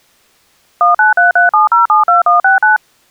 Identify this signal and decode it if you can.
DTMF, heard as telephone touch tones, dialled by machine, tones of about 140 ms. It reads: 19337072169